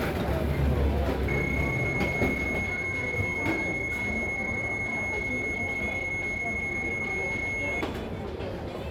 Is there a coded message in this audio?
Yes: PSK31 (31.25 baud) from 1.3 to 7.8 s, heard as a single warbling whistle, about 2150 Hz, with the noise of a crowd indoors.